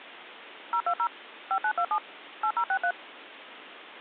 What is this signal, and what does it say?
DTMF, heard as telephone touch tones, dialled by machine, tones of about 70 ms. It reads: 020 5927 8063